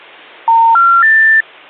Telephone call progress tone (North American plan), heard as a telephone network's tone, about 910, 1370, 1800 Hz. Special information tone.